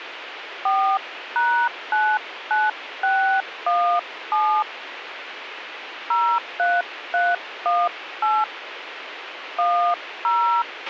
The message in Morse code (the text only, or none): none